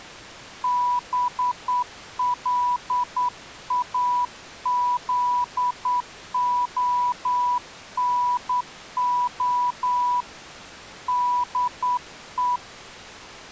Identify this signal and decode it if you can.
Morse code, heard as a keyed tone, hand-sent with a straight key, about 9 wpm, 980 Hz. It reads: BLAZONO DE